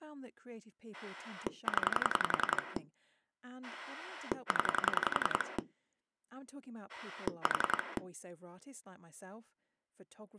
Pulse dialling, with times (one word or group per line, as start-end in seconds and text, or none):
0.9-2.8 0
3.6-5.6 0
6.9-8.0 4